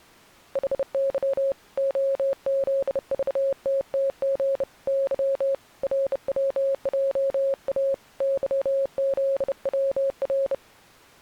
Morse code, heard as a keyed tone, hand-sent with a bug key, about 30 wpm, 540 Hz. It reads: HY OZVTTG Y RWJA YZWR